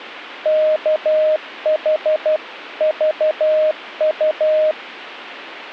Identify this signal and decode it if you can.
Morse code (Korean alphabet), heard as a keyed tone, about 12 wpm, 620 Hz. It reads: 우리